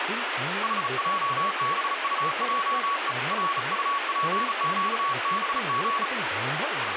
Morse code, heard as a keyed tone, hand-sent with a bug key, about 35 wpm, 1120 Hz, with radio static and speech in Santali. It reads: HJBUJE RUPQBG